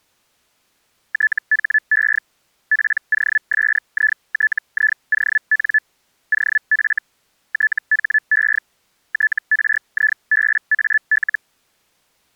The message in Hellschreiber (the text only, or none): THE POSITION OF THE TRIBAL